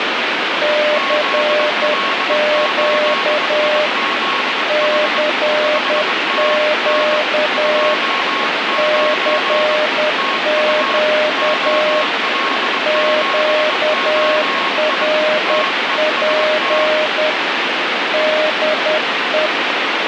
Morse code, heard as two keyed tones, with heavy radio static. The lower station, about 10 wpm, 610 Hz: CQ CQ CQ QRP DE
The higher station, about 22 wpm, 1090 Hz: ZL8IZH 5NN 29 TU OL7OI TEST